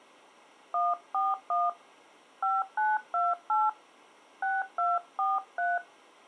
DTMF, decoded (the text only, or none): 141 5928 6243